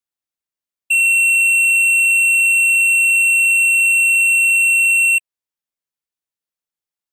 A steady tone. There is no code.